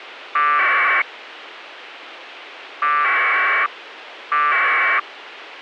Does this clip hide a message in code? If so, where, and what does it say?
Yes: packet radio (AX.25, as in APRS), 1200 baud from 0.4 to 5.0 s, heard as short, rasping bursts, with radio hiss.